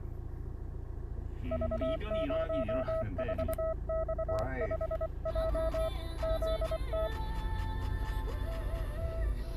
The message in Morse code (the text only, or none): V04X5J ZT